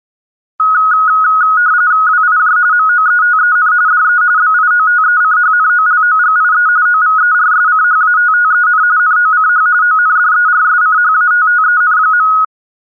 RTTY (45.45 baud, 170 Hz shift), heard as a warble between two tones, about 1360 Hz centre. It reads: WIJ MOETEN DE BIOTECHNOLOGIE OVERSCHATTEN NOCH ONDERSCHATTEN.